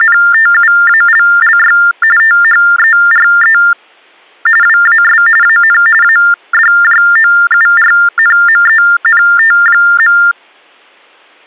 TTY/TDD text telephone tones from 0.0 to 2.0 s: …

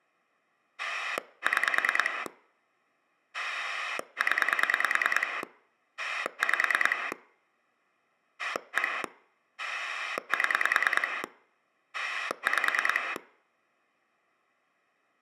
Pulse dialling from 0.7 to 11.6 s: 6 0 5 1 7

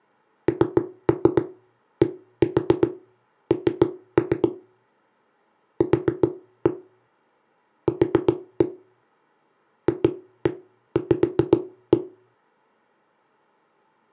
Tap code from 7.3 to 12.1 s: Q FV

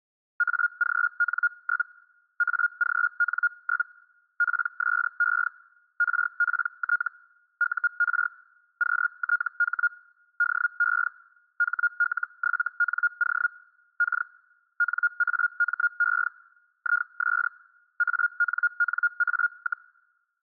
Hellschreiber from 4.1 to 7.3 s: PSE RPT

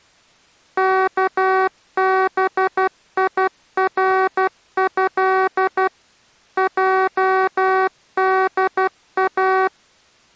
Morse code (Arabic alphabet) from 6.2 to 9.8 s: جدا

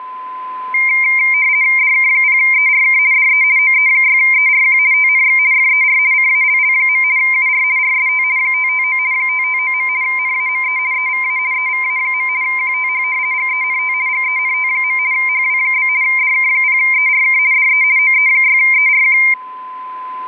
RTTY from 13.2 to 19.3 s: GENT GENT. HW? DK0ERK DE OE6ERQ

